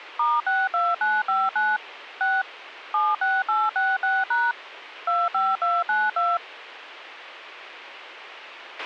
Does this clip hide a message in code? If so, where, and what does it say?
Yes: DTMF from 0.2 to 6.4 s, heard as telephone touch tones, dialled by machine, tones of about 210 ms, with a squelch burst at the end. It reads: *62959 6 76866# 25292